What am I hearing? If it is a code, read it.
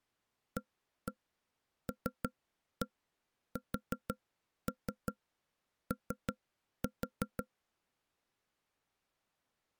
Tap code, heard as knocks on wood, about 5 knocks a second. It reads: ALSO